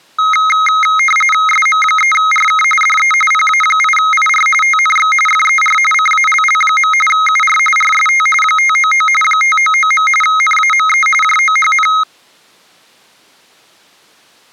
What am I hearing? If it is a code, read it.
RTTY (45.45 baud, 850 Hz shift), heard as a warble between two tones, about 1700 Hz centre. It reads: SM3RK DE PA8IR TNX FER CALL. UR RST 599 599. NAME JOHN